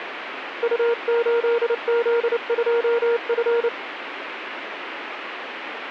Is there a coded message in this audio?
Yes: Morse code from 0.6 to 3.7 s, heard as a keyed tone, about 29 wpm, 470 Hz, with radio static. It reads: U8Z2F